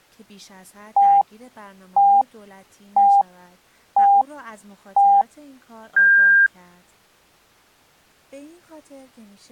Radio time signal (five pips and a higher one, as on Chinese radio), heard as pips, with speech in Persian.